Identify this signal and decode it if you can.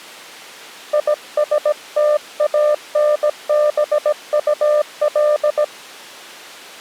Morse code, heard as a keyed tone, hand-sent with a paddle, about 17 wpm, 600 Hz. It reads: ISTANBUL